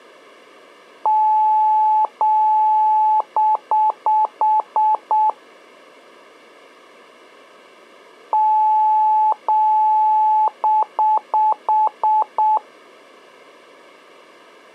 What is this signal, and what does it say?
Beep code, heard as beeps, played twice, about 860 Hz. 2 long, 6 short.